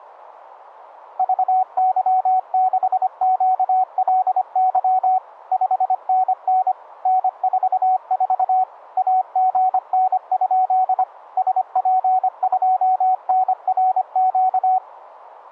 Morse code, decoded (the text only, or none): VY6QLY 5NN N44 AGN? SP2NRQ